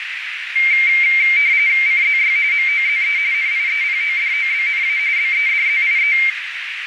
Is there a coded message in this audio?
Yes: RTTY (45.45 baud, 170 Hz shift) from 0.6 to 6.3 s, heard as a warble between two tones, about 2200 Hz centre, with radio static and a narrow filter. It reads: CZY MOZE NIEPODOBNA BEDZIE